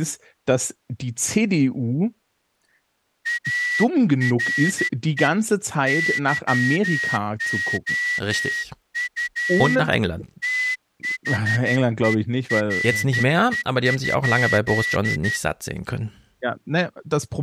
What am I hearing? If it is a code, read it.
Morse code, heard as a whistle, hand-sent with a straight key, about 12 wpm, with speech in German. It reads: ARE YOU THERE?